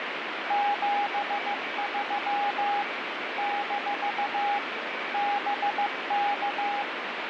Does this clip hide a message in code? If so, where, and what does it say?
Yes: Morse code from 0.4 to 6.9 s, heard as a keyed tone, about 15 wpm, 820 Hz, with radio static. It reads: 73 - BK